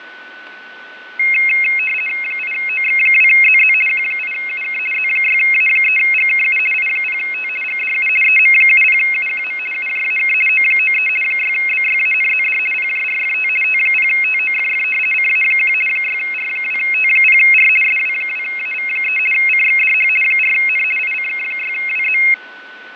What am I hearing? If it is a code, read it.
RTTY (50 baud, 450 Hz shift), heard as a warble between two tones, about 2350 Hz centre, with radio static, fading and a steady whistle near 1500 Hz. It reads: 8OX2ZZ Q8UK Z6A3GKU I0T GDU EM70UQM UJAK O93 6BYANZD PJRFT T0TOFF CA1 6R2T0R SW2AV3 CXDH 4N ICK6WZ